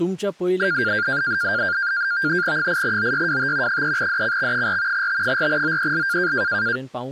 NAVTEX (SITOR-B), 100 baud, 170 Hz shift, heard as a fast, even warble, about 1500 Hz centre, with speech in Goan Konkani. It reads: 8OYWT 3DCX4 T4OEL